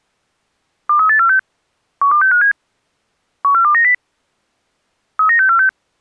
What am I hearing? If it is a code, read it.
Five-tone selective call (CCIR), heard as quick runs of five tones, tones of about 100 ms. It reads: 23846 12657 14290 39646